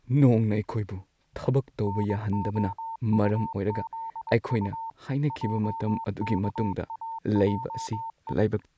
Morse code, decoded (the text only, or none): NOUZU JKAJE